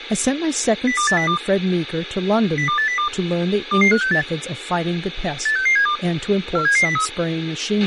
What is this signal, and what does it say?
Five-tone selective call (CCIR), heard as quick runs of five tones, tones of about 100 ms, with radio hiss, a squelch burst at the end and speech in English. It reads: 02802 02802 22568 86672 47703